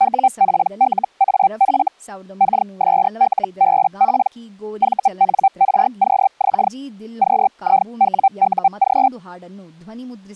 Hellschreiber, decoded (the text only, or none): WPLAF KSLBP VNRQX QIWUG